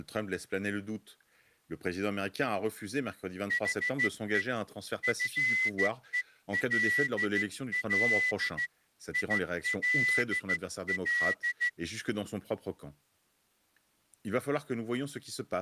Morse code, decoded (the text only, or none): HE FELL ILL